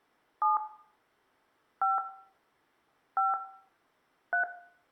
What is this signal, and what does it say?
DTMF, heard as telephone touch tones, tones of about 120 ms, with room echo. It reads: 7 5 5 3